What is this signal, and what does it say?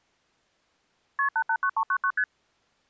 Multi-frequency trunk signalling (R1, as on North American trunks), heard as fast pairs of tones, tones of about 70 ms. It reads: KP 889399 ST